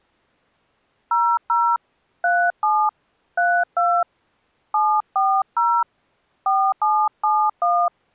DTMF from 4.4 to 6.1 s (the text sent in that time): 740